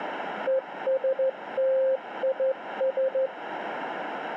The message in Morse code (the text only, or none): ESTIS